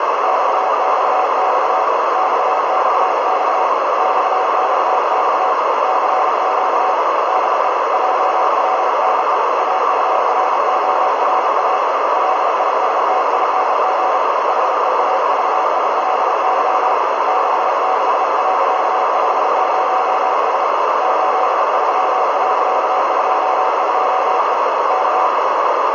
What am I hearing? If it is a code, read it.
Morse code, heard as a keyed tone, hand-sent with a bug key, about 33 wpm, 750 Hz, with heavy radio static and a narrow filter. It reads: XXX XXX XXX CQ DE JLNE AURORA LISTING HEAVILY 66.50S 83.22E K